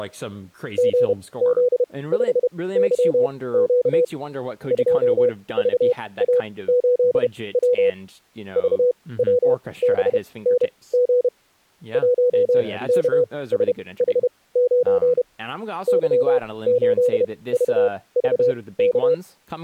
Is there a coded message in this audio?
Yes: Morse code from 0.7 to 19.2 s, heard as a keyed tone, machine-sent, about 31 wpm, spaced as for 20 wpm, 490 Hz, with speech in English. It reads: GZ5YQ 2VA8W VWBNG 1KSH9 Y8VVK